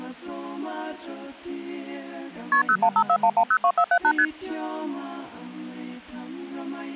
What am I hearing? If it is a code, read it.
Multi-frequency trunk signalling (R1, as on North American trunks), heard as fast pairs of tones, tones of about 70 ms. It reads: KP 01541102478 ST